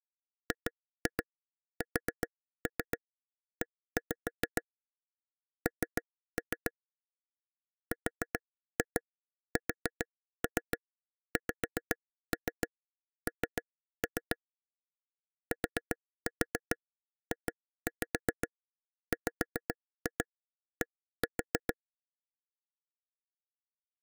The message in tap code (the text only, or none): GSE N RSXN TJWD